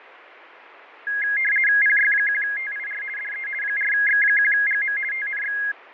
RTTY (50 baud, 450 Hz shift), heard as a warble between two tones, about 1900 Hz centre, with radio static and fading. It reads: PY1TIR DE 4X1GM TNX